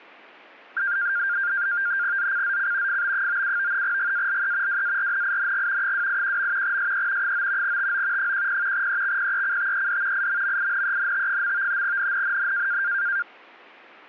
NAVTEX (SITOR-B), 100 baud, 170 Hz shift, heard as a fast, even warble, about 1500 Hz centre. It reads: ZCZC FB97 GALE WARNING 281. SE 9 TO 10 EXPECTED IMMINENT. NNNN